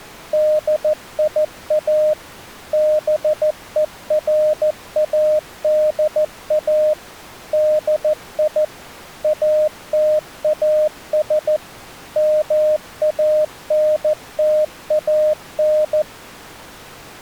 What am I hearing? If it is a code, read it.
Morse code, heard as a keyed tone, machine-sent, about 14 wpm, 610 Hz. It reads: DIA BERADA DI ATAS MANTAN